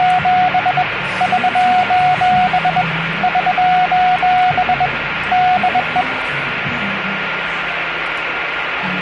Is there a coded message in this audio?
Yes: Morse code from 0.0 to 6.1 s, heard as a keyed tone, hand-sent with a bug key, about 21 wpm, 730 Hz, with radio static, a steady whistle near 1410 Hz and the noise of a cafe. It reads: … <SOS> <SOS> DE